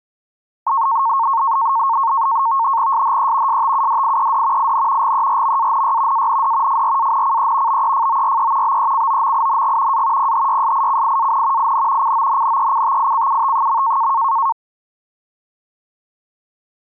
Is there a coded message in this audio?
Yes: NAVTEX (SITOR-B), 100 baud, 170 Hz shift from 0.7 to 14.5 s, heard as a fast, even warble, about 1000 Hz centre. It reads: SHE STUDIED IN GERMANY AND FRANCE BEFORE BECOMING A PHYSICIAN IN CONNECTICUT.